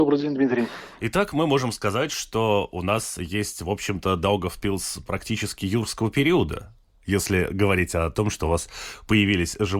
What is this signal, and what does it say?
Speech in Russian. There is no code.